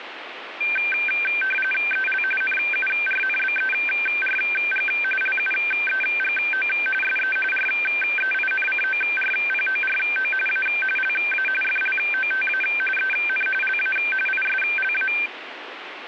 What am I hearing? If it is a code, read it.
RTTY (45.45 baud, 850 Hz shift), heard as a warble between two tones, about 1950 Hz centre, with radio static. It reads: EL NURNBERG LUEGO SE REINCORPORO A LA FLOTA EN LA ISLA